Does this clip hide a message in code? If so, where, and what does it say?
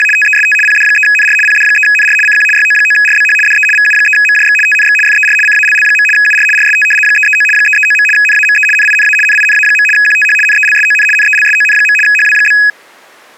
Yes: RTTY (75 baud, 850 Hz shift) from 0.0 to 12.7 s, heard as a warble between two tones, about 2100 Hz centre. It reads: … TEST PD3NR PD3NR CQ YO9RBH DE VU3MJX TNX FER CALL. UR RST 339 339. NAME NINA NINA. QTH NELSON NELSON. HW?